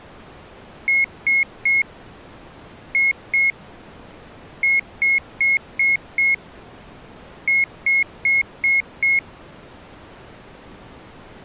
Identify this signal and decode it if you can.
Beep code, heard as a piezo beeper, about 2150 Hz. 3-2-5-5.